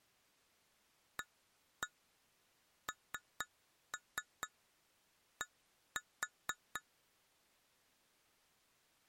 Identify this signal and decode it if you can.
Tap code, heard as taps on glass, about 4 knocks a second. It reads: AND